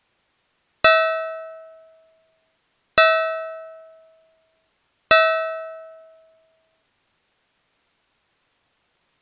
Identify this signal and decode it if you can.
Clock strike, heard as a bell. 3. Three o'clock.